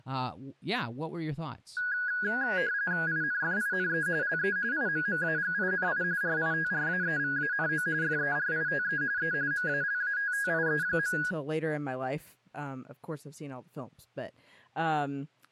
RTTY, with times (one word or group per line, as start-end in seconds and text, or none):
3.1-4.1 INFINE
4.2-4.6 LE
4.7-6.0 IMMAGINI
6.2-7.9 RITRAEVANO
8.0-9.0 FERITE
9.2-9.3 E
9.5-11.2 MALATTIE.